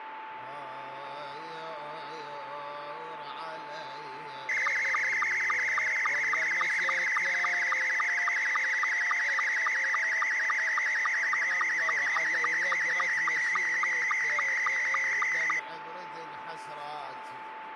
SSTV (slow-scan television), Scottie S2, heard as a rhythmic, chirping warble, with radio static and a steady whistle near 880 Hz.